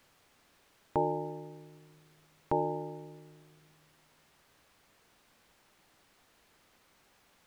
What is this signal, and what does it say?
Clock strike, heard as a bell. 2. Two o'clock.